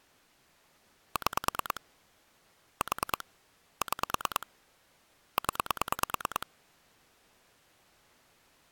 Pulse dialling, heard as clicks on a phone line, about 9 pulses a second. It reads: 6 4 6 0